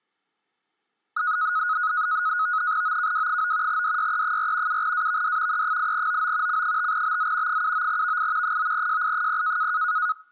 NAVTEX (SITOR-B), 100 baud, 170 Hz shift, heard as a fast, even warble, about 1360 Hz centre. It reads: OKW9 DYE4 7AVD E8OO C5BZ 79VI 9JI0